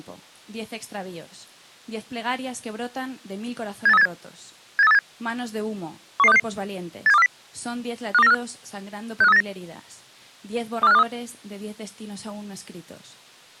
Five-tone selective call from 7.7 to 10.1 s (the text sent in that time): 52945 65389